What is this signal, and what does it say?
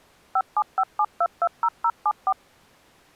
DTMF, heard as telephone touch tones, dialled by machine, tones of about 60 ms. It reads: 5757220074